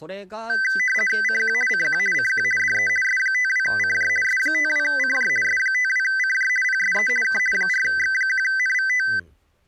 RTTY (50 baud, 450 Hz shift), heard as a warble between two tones, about 1750 Hz centre, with speech in Japanese. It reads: CQ CQ CQ DE S52CJ S52CJ S52CJ PSE K 4X1NVT